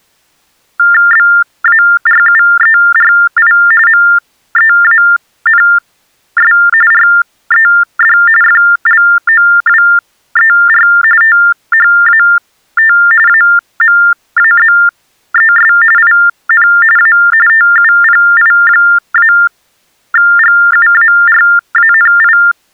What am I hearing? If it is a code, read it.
TTY/TDD text telephone tones (45.45 baud Baudot), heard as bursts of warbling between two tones, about 400 Hz shift, 1600 Hz centre. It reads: BARUERI MEANS RED FLOWER THAT AMAZES IN A TUPI-GUARANI